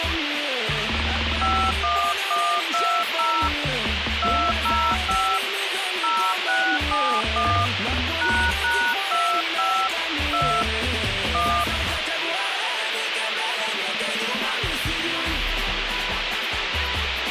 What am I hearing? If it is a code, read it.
DTMF, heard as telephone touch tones, dialled by hand, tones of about 300 ms, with radio hiss. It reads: 51120 205 0671 ##25 2 1